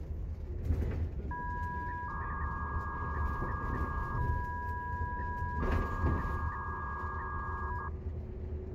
300-baud modem data (V.21 tones), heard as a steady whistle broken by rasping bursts, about 300 baud, 200 Hz shift, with the noise inside a bus.